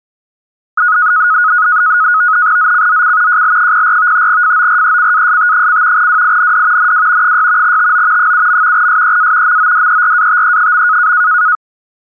NAVTEX (SITOR-B), 100 baud, 170 Hz shift, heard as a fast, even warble, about 1360 Hz centre. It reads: ZCZC JL04 FORECAST: WIND NW 6 TO 7. SEA MODERATE.